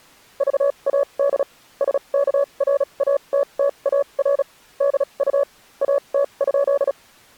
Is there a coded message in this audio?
Yes: Morse code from 0.3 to 7.0 s, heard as a keyed tone, machine-sent, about 36 wpm, spaced as for 29 wpm, 560 Hz. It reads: VAD SKRATTAR DU AT?